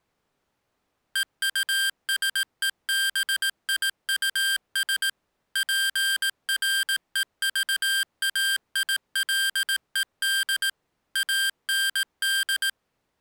Morse code, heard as electronic beeps, machine-sent, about 18 wpm, 1600 Hz. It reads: EUSEBIUS PREVAILED AND